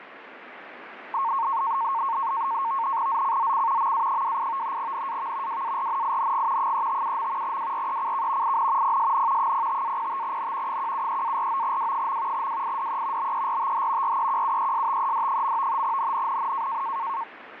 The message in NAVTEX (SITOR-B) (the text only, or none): ZCZC MA28 NAV WARNING 357. WRECK IN PSN 05-05N 173-49W. WIDE BERTH REQUESTED. NNNN